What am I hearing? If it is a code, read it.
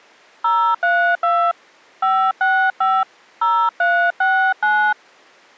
DTMF, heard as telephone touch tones, dialled by hand, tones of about 280 ms. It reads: 032 565 0369